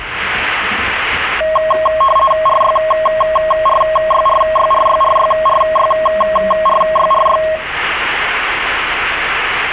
RTTY (50 baud, 450 Hz shift), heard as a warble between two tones, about 860 Hz centre, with the noise inside a subway train. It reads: RYRYRYRYRYRYRYRY